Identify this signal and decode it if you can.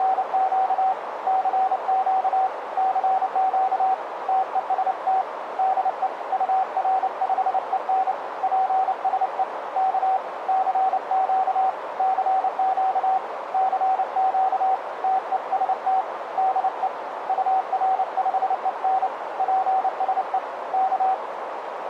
Morse code, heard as a keyed tone, hand-sent with a paddle, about 29 wpm, 760 Hz, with radio static and a narrow filter. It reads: … CQ CQ TEST DE UR5EN PSE K CQ CQ CQ TEST DE UR5EN PSE K